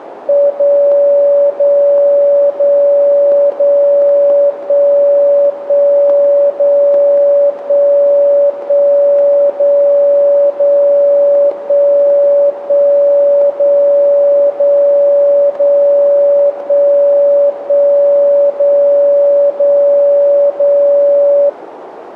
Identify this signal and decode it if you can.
Radio time signal (DCF77), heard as a tone whose level steps once a second, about 570 Hz, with radio static. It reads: 0 0 0 0 1 1 0 1 1 0 0 1 1 0 0 0 1 1 0 0 0